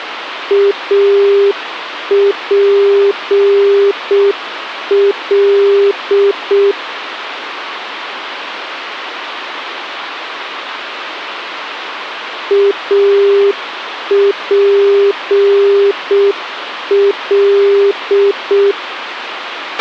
Morse code, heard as a keyed tone, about 6 wpm, 400 Hz, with radio hiss and a squelch burst at the end. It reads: APL APL